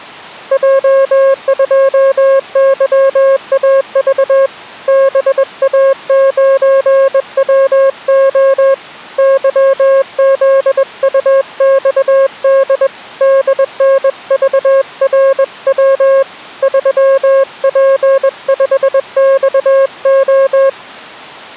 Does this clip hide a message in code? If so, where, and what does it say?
Yes: Morse code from 0.5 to 20.8 s, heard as a keyed tone, hand-sent with a bug key, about 21 wpm, 540 Hz. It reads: J2YAV BA9WO YZUXD DNVRW 3P5XO